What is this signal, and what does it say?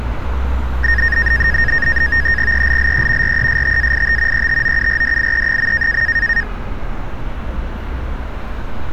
NAVTEX (SITOR-B), 100 baud, 170 Hz shift, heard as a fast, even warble, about 1750 Hz centre, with street noise. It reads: ELLE RESTAIT ETOURDIE.